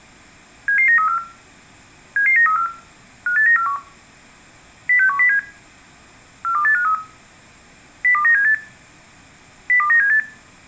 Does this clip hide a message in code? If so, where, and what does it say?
Yes: five-tone selective call (CCIR) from 0.7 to 10.2 s, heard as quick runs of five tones, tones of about 100 ms, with room echo. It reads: 77934 77934 58941 06107 42853 02978 02978